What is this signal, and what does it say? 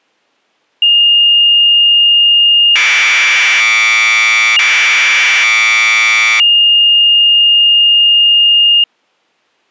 Commodore tape loading (standard loader), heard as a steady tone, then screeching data.